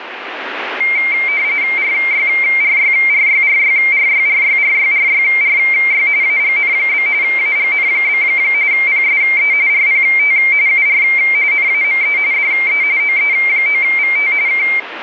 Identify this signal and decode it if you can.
RTTY (45.45 baud, 170 Hz shift), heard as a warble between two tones, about 2200 Hz centre, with radio static. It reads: RYRYRYRYRYRYRYRYRY AGN? AGN? PSE RPT UR NAME DE OE9VT K